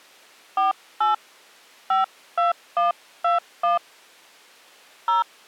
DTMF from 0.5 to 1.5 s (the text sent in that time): 48